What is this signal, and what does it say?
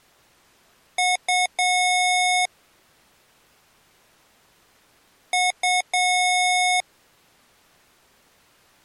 Beep code, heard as beeps from a small speaker, played twice, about 730 Hz. 2 short, 1 long.